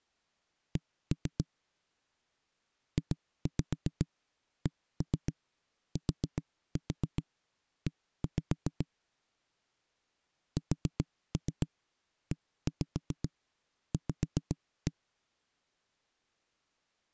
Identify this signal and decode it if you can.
Tap code, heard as knocks on a wall, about 7 knocks a second. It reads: C JCTE SEV